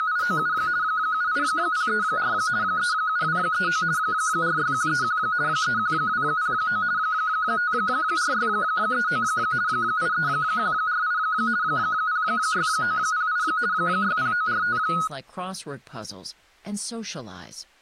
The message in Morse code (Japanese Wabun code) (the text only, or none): none